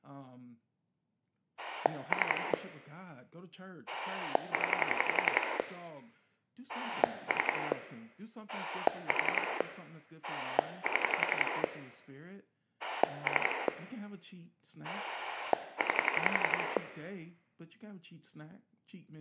Pulse dialling, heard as a rotary dial, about 11 pulses a second, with room echo and speech in English. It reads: 3 0 3 4 7 3 9